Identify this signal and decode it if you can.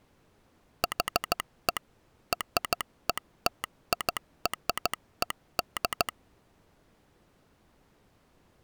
Morse code (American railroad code), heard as a telegraph sounder, machine-sent. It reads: HE RETIRED